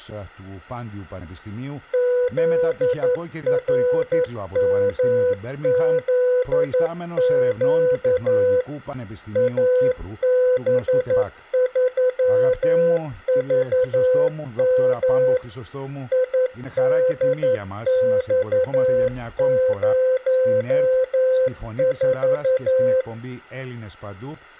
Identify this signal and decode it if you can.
Morse code, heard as a keyed tone, machine-sent, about 11 wpm, 510 Hz. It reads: ZRMZQ AB3VM IDX04